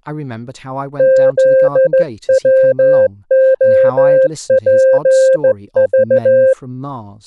Morse code, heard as a keyed tone, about 14 wpm, 530 Hz, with speech in English. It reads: ZWOPV